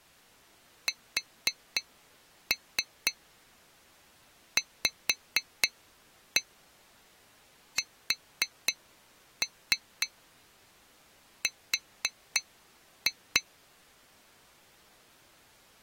Tap code, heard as taps on glass, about 4 knocks a second. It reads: SVSR